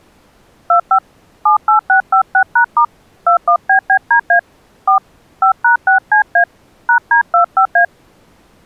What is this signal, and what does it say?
DTMF, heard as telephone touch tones, dialled by hand, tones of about 100 ms. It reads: 25 78656#* 21BBDA 4 5#6CA #D25A